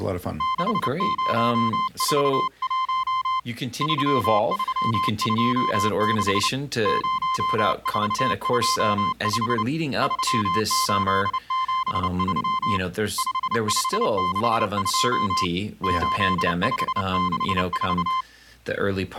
Morse code, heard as a keyed tone, hand-sent with a paddle, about 29 wpm, 1040 Hz, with speech in English. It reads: 6041 3326 0425 3873 5562 8564